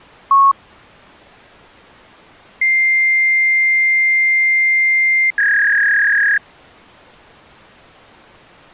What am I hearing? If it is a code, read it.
Fax machine handshake, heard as a long tone and a warble.